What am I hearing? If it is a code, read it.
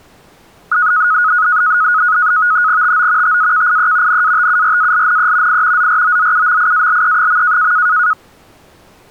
NAVTEX (SITOR-B), 100 baud, 170 Hz shift, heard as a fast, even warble, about 1360 Hz centre. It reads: TO TAKIE NATURALNE I ZROZUMIALE.